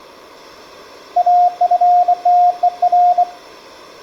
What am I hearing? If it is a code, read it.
Morse code, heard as a keyed tone, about 24 wpm, 710 Hz. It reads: AFTER